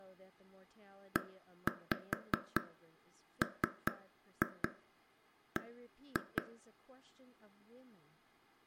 Tap code, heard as taps on a table, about 4 knocks a second, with room echo and speech in English. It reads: EMB